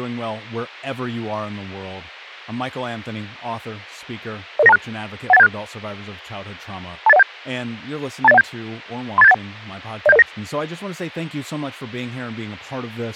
Five-tone selective call (EIA), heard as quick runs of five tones, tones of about 30 ms, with speech in English. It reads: 00926 18176 28017 28017 38781 07009